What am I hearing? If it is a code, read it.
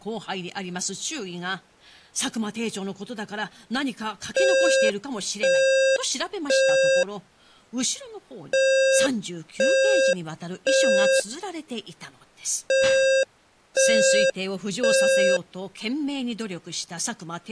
Alarm pattern, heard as an alarm's beeps, played three times, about 530 Hz, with speech in Japanese. Temporal three. Smoke or fire, evacuate.